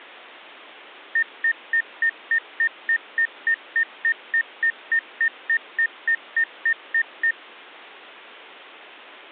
Evenly repeated beeps. There is no code.